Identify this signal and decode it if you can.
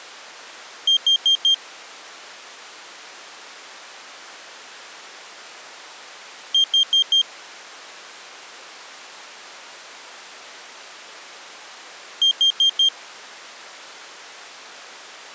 Alarm pattern, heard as an alarm's beeps, played three times, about 3200 Hz. Temporal four. Carbon monoxide.